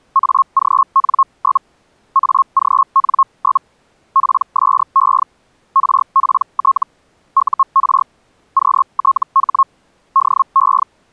Hellschreiber (Feld-Hell, 122.5 baud), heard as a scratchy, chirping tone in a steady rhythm, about 1080 Hz. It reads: AGN? AGN? PSE RPT UR QTH DE